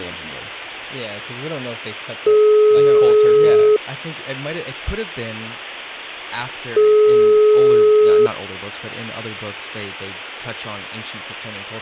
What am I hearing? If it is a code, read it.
Telephone call progress tone (single-tone plan, as in most of Europe), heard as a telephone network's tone, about 420 Hz, 1.5 s on and 3 s off, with hum and speech in English. Ringback tone.